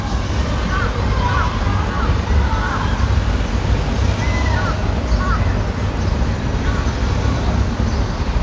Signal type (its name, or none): none